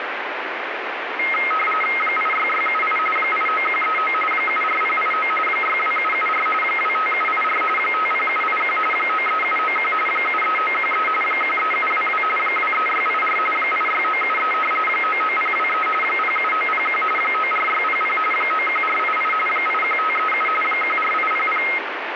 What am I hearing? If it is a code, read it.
RTTY (45.45 baud, 850 Hz shift), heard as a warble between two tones, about 1700 Hz centre, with radio static. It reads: 86678 89139 74089 62774 25784 50781 93791 73913 13722 23684 86973 99023 07901 94600 91488 81537 14800